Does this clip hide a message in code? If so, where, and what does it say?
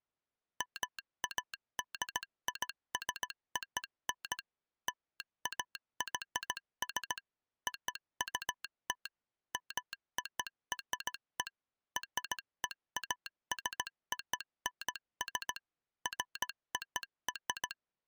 Yes: Morse code (American railroad code) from 0.5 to 17.8 s, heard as a telegraph sounder, machine-sent. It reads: MADISON LAYS OUT MORE REASONS FOR